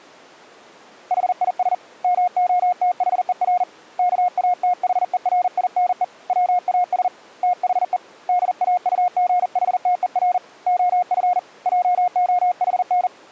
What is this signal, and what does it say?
Morse code, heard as a keyed tone, hand-sent with a paddle, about 40 wpm, 720 Hz. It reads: HIS MOTHER KATHERINE WAS THE DAUGHTER OF JOHN